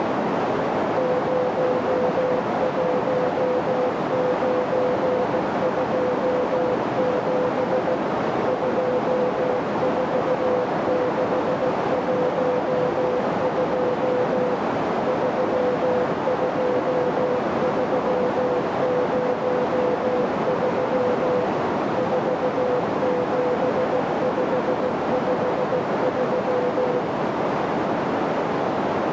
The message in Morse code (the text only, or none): 01927 24612 32303 47553